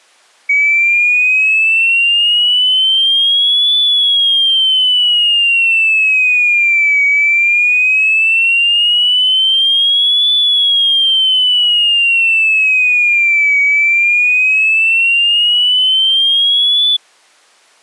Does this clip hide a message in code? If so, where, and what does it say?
No, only a tone that sweeps in pitch again and again.